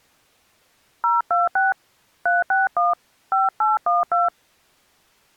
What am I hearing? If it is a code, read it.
DTMF, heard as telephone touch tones, dialled by hand, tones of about 170 ms. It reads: 026 361 5812